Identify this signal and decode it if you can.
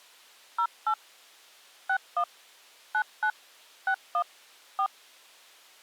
DTMF, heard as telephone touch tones, dialled by hand, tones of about 80 ms. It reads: 08 61 99 61 4